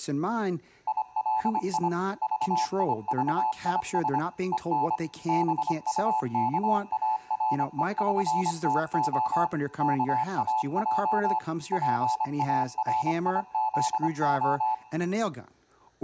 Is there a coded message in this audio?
Yes: Morse code (with Esperanto letters) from 0.8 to 14.8 s, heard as a keyed tone, machine-sent, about 25 wpm, 870 Hz, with room echo and speech in English. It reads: ILI VIVIS EN BUKAREŜTO KAJ PARIZO